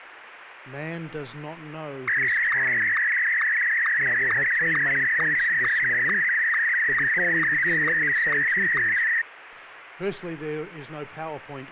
SSTV (slow-scan television), Martin M1, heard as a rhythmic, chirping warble.